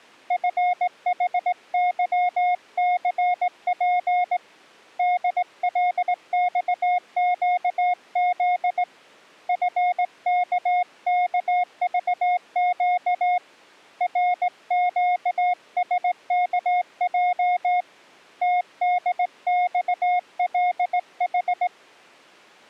Morse code, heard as a keyed tone, hand-sent with a straight key, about 18 wpm, 720 Hz. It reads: FHYCP DLXQZ FKKVQ RQSKJ TDXLH